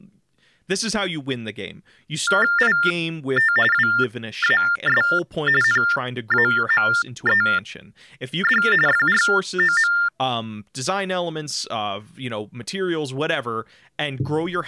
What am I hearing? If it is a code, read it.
TTY/TDD text telephone tones (45.45 baud Baudot), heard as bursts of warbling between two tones, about 400 Hz shift, 1600 Hz centre, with speech in English. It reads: IT WAS NAMED FROM